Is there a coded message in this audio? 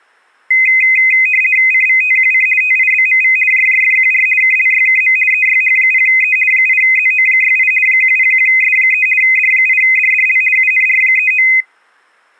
Yes: RTTY (50 baud, 450 Hz shift) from 0.5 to 11.6 s, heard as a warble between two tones, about 2300 Hz centre. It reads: CVTQC TIBMV JJFQR KLYKM EYH0E 8ZO68 101S3 D8DDL UNR39